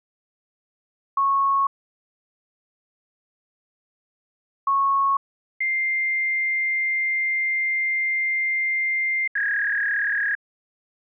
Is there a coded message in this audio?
Yes: fax machine handshake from 1.2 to 10.4 s, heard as beeps, a long tone and a warble.